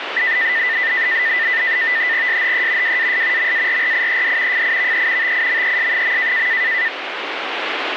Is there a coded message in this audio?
Yes: NAVTEX (SITOR-B), 100 baud, 170 Hz shift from 0.2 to 6.9 s, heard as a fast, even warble, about 1900 Hz centre, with radio static. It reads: SHE WAS MARRIED FIVE TIMES.